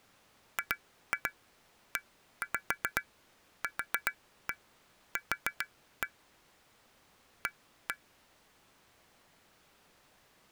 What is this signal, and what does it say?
Tap code, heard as taps on glass, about 7 knocks a second. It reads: GEQQ A